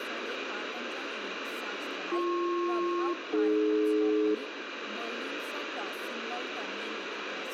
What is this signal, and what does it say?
Aircraft SELCAL, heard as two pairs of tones, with radio static, room echo and speech in Nepali. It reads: BP-AD